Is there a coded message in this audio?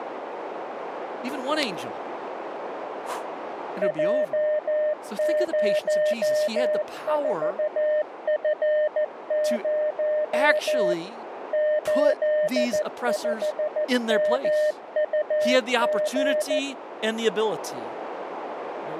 Yes: Morse code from 3.8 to 16.6 s, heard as a keyed tone, machine-sent, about 14 wpm, 610 Hz, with radio static, a narrow filter and speech in English. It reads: J04F0 85MUG